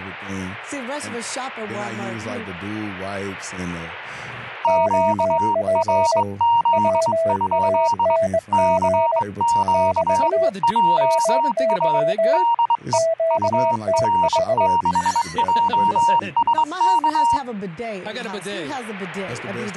Morse code, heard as two keyed tones. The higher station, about 22 wpm, 940 Hz: QRZ? CQ JA DE UR6JSK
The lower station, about 21 wpm, 660 Hz: OP WANG <BT> MY QTH